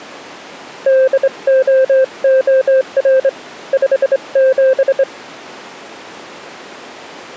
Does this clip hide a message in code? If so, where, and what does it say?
Yes: Morse code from 0.8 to 5.1 s, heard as a keyed tone, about 24 wpm, 520 Hz. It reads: DOOR 57